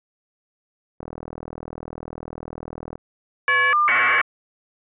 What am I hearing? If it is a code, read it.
Caller ID data burst, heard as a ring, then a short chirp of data, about 1200 baud.